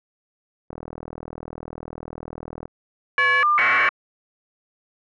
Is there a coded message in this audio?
Yes: caller ID data burst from 0.7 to 3.9 s, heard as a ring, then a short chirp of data, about 1200 baud.